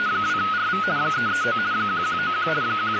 RTTY (50 baud, 170 Hz shift), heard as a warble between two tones, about 1360 Hz centre, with radio static. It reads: … 339 1191 …